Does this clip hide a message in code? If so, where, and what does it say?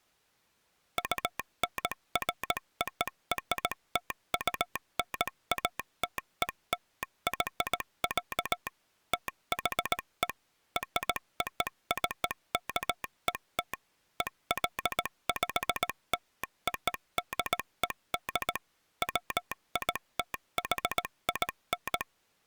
Yes: Morse code (American railroad code) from 0.9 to 22.1 s, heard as a telegraph sounder, machine-sent. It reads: UNFORTUNATELY, THE ROCKET EXPLODED WITHIN